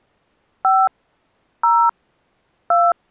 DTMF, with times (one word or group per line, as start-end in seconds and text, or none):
0.6-0.9 5
1.6-1.9 0
2.7-2.9 2